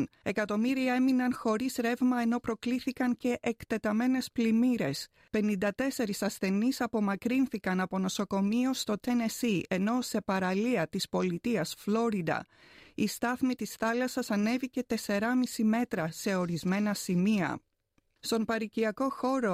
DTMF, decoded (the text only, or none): none